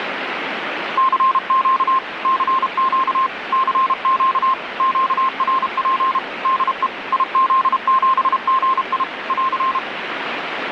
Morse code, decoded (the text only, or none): CQ CQ CQ QRP DE IZ7GI <AR>